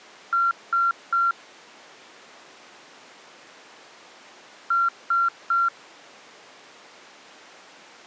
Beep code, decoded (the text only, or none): 3 short